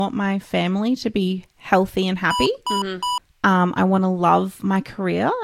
Beep code, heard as beeps from a small speaker, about 990 Hz, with speech in English. 3 short. In AMI BIOS tables: failure in the first 64 KB of memory; in Dell tables: chipset error.